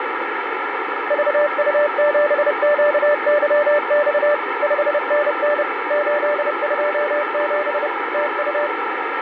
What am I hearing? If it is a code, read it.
Morse code, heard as a keyed tone, machine-sent, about 30 wpm, 590 Hz, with radio static. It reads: VU7QYX 5NN 827 TU